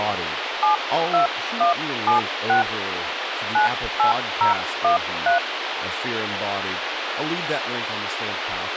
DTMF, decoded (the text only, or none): 72176 98013